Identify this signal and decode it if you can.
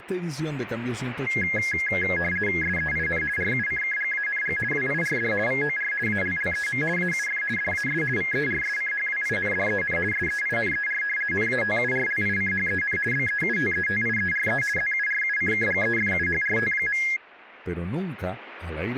RTTY (50 baud, 450 Hz shift), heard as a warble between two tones, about 1900 Hz centre, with radio static and speech in Spanish. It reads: SEIN RUCKGANG WIRD VOR ALLEM AUF DAS VERSCHWINDEN SEINER NATURLICHEN BEUTETIERE ZURUCKGEFUHRT.